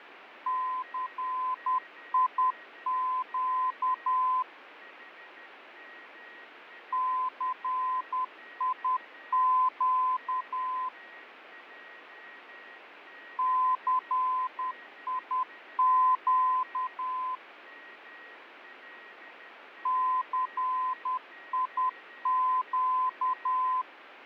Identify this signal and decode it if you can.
Morse code, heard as a keyed tone, machine-sent, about 10 wpm, 1020 Hz, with radio static, fading and a weaker station near 1890 Hz. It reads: CIQ CIQ CIQ CIQ